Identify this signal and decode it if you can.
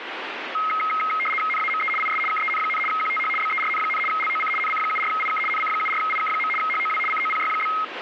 RTTY (75 baud, 850 Hz shift), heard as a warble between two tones, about 1700 Hz centre, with radio static. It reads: NAME IS KEN, QTH BERN, LOC NC74IK NC74IK. HOW COPY?